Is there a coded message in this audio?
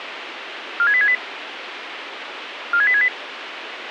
Yes: five-tone selective call (ZVEI) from 0.8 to 3.1 s, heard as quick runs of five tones, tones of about 70 ms, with radio hiss and a squelch burst at the end. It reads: 46868 46868